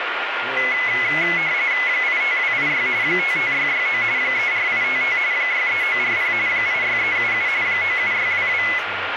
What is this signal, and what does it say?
RTTY (45.45 baud, 170 Hz shift), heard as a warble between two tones, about 2100 Hz centre, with radio static, a steady whistle near 1410 Hz and speech in English. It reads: 85286 55669 34855 63940 86377 97622